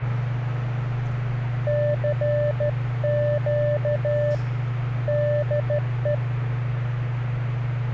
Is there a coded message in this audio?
Yes: Morse code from 1.6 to 6.2 s, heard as a keyed tone, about 14 wpm, 590 Hz, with the noise inside a lift. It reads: CQ DE